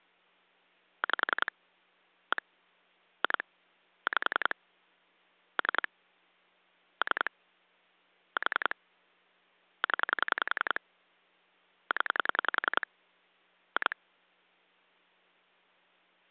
Pulse dialling, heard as clicks on a phone line, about 10 pulses a second. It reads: 5 1 2 5 3 3 4 0 0 2